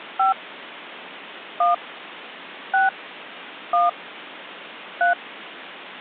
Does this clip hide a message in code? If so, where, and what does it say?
Yes: DTMF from 0.2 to 5.1 s, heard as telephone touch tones, dialled by hand, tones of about 140 ms. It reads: 5 1 6 1 3